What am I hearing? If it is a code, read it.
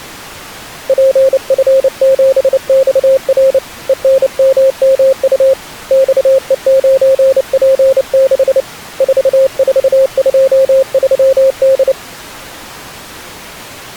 Morse code, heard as a keyed tone, hand-sent with a paddle, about 29 wpm, 530 Hz. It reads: PF7XR ENMMU XE9P6 4423D